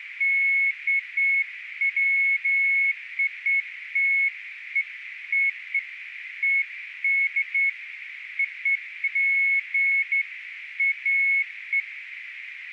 Beeps of irregular length, with radio static and a narrow filter. There is no code.